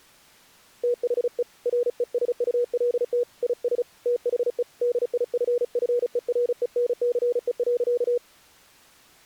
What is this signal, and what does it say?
Morse code, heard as a keyed tone, hand-sent with a paddle, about 35 wpm, 480 Hz. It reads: THE RESULT IS THE DIFFERENCE.